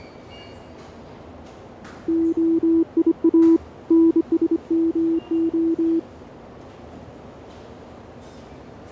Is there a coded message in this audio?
Yes: Morse code (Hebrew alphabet) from 2.0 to 6.1 s, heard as a keyed tone, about 25 wpm, 330 Hz, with radio static and the noise of a subway station. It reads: היא נשמה